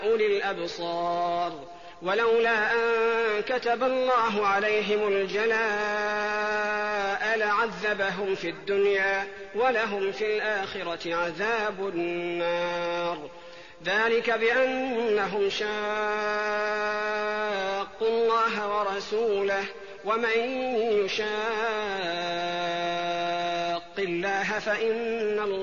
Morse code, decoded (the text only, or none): none